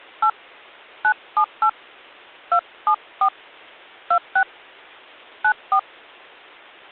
DTMF, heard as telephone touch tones, dialled by hand, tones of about 80 ms. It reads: 8 978 274 26 94